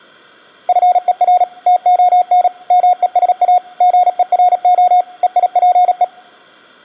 Morse code (Greek alphabet), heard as a keyed tone, machine-sent, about 37 wpm, 720 Hz. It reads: ΦΕΡ ΤΟΝ ΜΕΣΑ ΓΕΡΟ ΕΙΠΕ